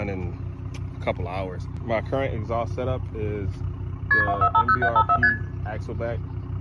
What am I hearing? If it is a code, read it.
Multi-frequency trunk signalling (R1, as on North American trunks), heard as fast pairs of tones, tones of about 70 ms, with room echo. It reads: KP 2450754 ST